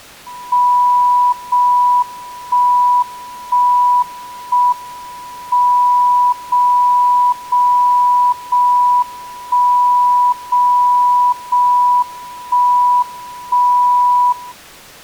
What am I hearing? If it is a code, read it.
Radio time signal (JJY), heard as a tone whose level steps once a second, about 980 Hz. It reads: 0 1 1 1 M 0 0 0 1 0 0 1 1 0